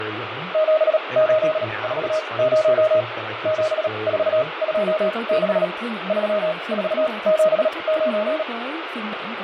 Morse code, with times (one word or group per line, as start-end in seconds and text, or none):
0.5-3.0 7840
3.5-5.6 7426
6.1-8.4 3479